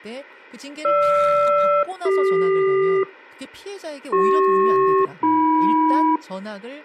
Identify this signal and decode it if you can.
Aircraft SELCAL, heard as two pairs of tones, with speech in Korean. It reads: GR-CQ CP-AM